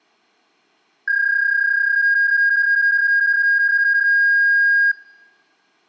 PSK31 (31.25 baud), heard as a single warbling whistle, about 1600 Hz.